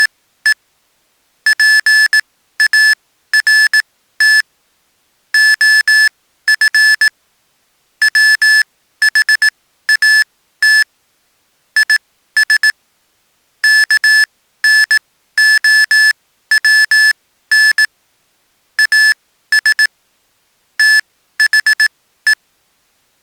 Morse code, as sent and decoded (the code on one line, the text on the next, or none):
… / .--. .- .-. - / --- ..-. / .-- .... .- - / .. ... / -.- -. --- .-- -. / .- ... / - .... .
… PART OF WHAT IS KNOWN AS THE